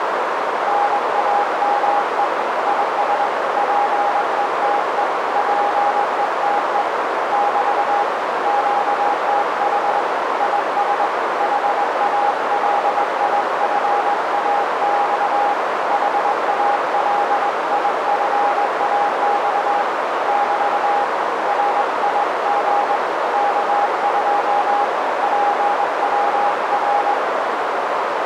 Morse code, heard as a keyed tone, hand-sent with a straight key, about 21 wpm, 820 Hz, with heavy radio static and a narrow filter. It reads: NAME IS PETE PETE <BT> QTH IS HALIFAX HALIFAX <BT> RIG K2 PWR